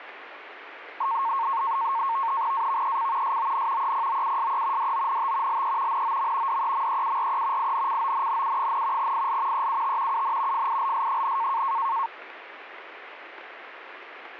NAVTEX (SITOR-B), 100 baud, 170 Hz shift, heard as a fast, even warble, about 1000 Hz centre, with radio static. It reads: AVEC SON EPOUSE DONT LE NOM DEMEURE INCONNU, IL EUT UN FILS,